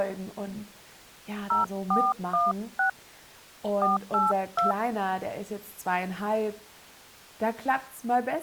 DTMF, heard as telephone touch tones, dialled by hand, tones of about 160 ms. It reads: 0416 482